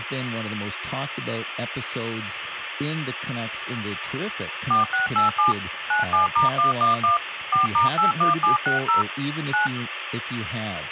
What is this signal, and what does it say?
DTMF, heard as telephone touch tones, dialled by machine, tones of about 130 ms, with phone line noise and speech in English. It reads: 4687 97*111 4*81760 9